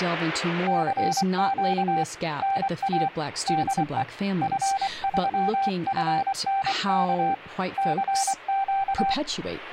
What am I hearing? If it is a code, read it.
Morse code, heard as a keyed tone, hand-sent with a paddle, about 24 wpm, 780 Hz, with speech in English. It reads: CQ NA DE F3FNK CQ